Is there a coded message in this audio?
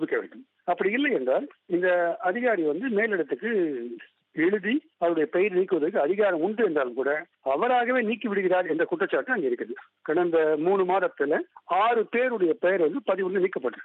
No.